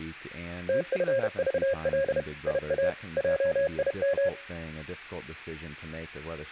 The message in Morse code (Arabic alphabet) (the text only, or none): تفضل يا جيم